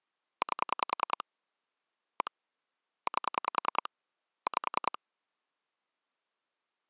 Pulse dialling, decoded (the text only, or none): 8 1 8 5